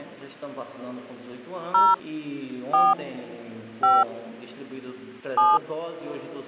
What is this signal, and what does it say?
DTMF, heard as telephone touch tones, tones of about 200 ms. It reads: 0 4 5 7